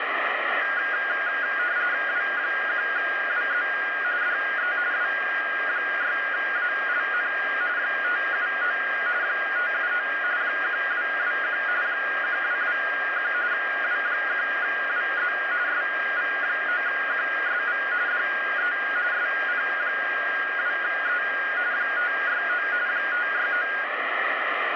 RTTY (45.45 baud, 170 Hz shift), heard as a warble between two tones, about 1550 Hz centre, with radio static. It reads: W1WZ DE W6ALN 579 579 1221 1221 W1WZ SV9QSV DE SP2E 569 569